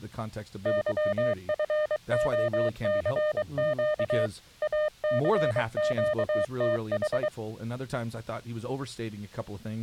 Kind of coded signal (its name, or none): Morse code